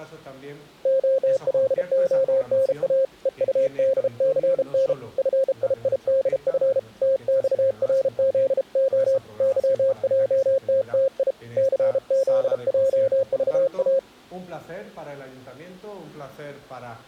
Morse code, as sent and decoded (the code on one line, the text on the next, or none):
--- .-.. --- -. .- / . ..- -.. -.-. -. / ..-. .. .. -.. ..-. / - -..- .-. --.. --- / -.-- .--- - - .. / -.-. --.. .--- ...- .-
OLONA EUDCN FIIDF TXRZO YJTTI CZJVA